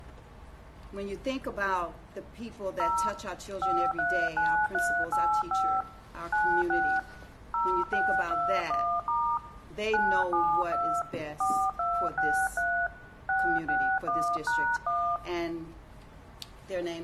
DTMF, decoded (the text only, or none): 0 539385 96 0621* 972 4263 661#1